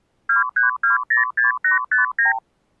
Multi-frequency trunk signalling (R2, with the far end's replies), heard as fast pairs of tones, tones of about 140 ms. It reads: 23206859